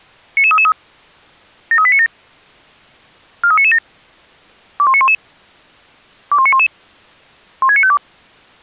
Five-tone selective call (ZVEI), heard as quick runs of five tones, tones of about 70 ms. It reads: 99333 73897 43997 21911 21911 16952